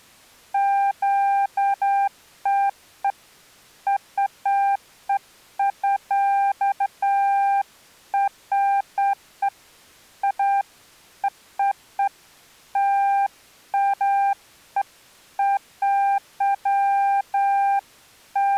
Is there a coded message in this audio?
No, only beeps of irregular length.